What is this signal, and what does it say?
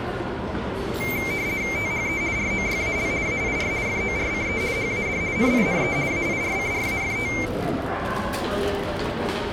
RTTY (50 baud, 170 Hz shift), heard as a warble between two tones, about 2200 Hz centre, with the noise of a crowd indoors. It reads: THE ROYAL AIR FORCE HAD NINE AIRCRAFT